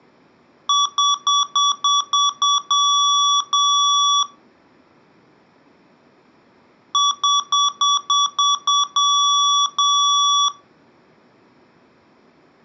Beep code, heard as beeps from a small speaker, played twice, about 1140 Hz. 7 short, 2 long.